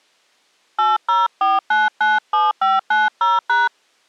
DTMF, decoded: 804997590#

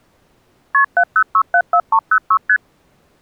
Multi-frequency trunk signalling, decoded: KP 70674306 ST

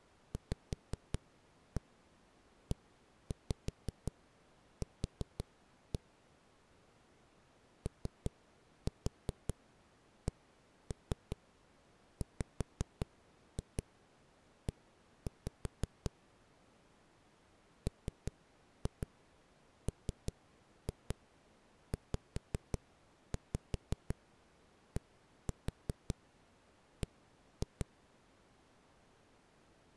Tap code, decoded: VEQ OCWE MMZDB

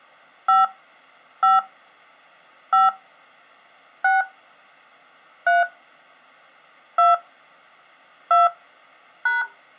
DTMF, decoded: 5 5 5 6 3 2 2 #

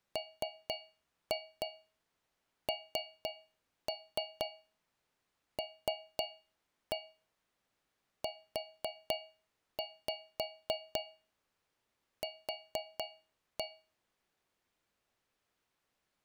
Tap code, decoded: MNLUQ

